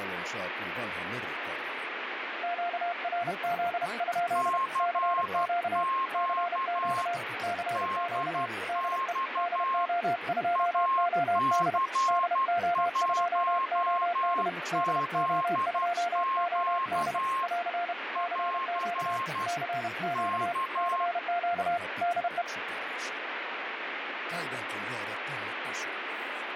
Morse code, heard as two keyed tones, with radio static. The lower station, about 31 wpm, 700 Hz: QRZ? CQ CQ CQ DE DO2OD DO2OD DO2OD <AR> CQ CQ CQ DE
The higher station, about 12 wpm, 1070 Hz: CQ DX AC1ZQ <AR> K